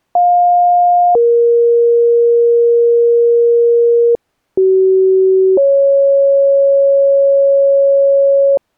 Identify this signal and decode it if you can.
Two-tone page, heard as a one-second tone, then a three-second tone, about 710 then 470 Hz, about 380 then 550 Hz.